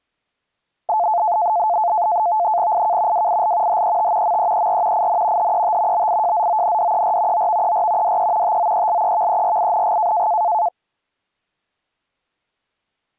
NAVTEX (SITOR-B), 100 baud, 170 Hz shift, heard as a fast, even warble, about 780 Hz centre. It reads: IK WIL HET MEER IN HET BIJZONDER OVER DE TOELEVERING